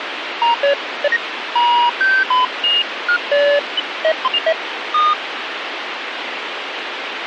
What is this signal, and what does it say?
Electronic bleeps of random pitch and length, with radio hiss. There is no code.